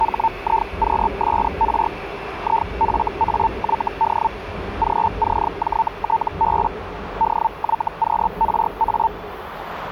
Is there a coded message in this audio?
Yes: Hellschreiber (Feld-Hell, 122.5 baud) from 0.0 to 9.1 s, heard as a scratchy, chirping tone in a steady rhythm, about 900 Hz, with radio static and the noise of a subway station. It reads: HIQSR IFAYD GCJTB DYQRA